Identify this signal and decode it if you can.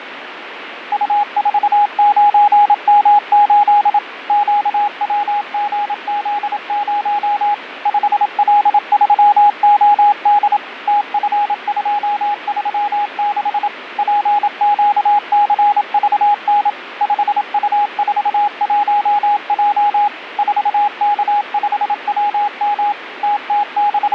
Morse code, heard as a keyed tone, machine-sent, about 27 wpm, 830 Hz, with radio static and fading. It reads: U49M8 QWGZ0 5L3OD TF236 PQCVN 5U41J 4K5WM …